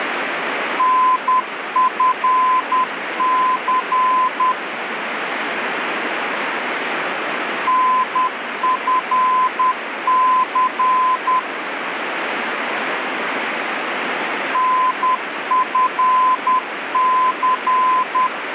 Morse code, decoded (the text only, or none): NFC NFC NFC